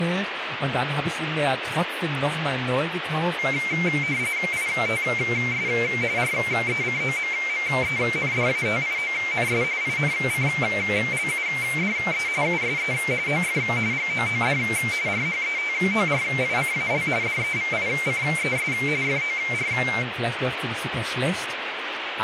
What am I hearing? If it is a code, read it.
RTTY (45.45 baud, 170 Hz shift), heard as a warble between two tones, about 2200 Hz centre, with radio static and speech in German. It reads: ITS RECOMMENDATIONS INCLUDE USE OF GOOD RHETORICAL DEVICES FOR